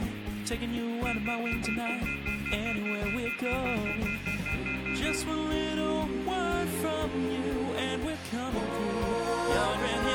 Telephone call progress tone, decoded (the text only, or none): off-hook warning tone